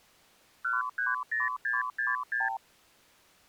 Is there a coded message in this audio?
Yes: multi-frequency trunk signalling (R2, with the far end's replies) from 0.6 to 2.6 s, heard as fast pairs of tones, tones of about 170 ms. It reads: 130666